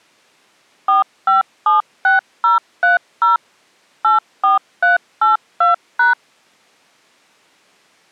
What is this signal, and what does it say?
DTMF, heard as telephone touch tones, dialled by machine, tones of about 140 ms. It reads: 4576030 84382#